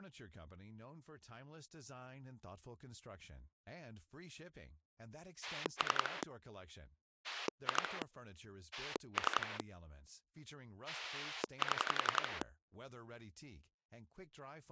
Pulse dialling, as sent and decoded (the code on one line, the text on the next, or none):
3 / 2 / 3 / 7
3 2 3 7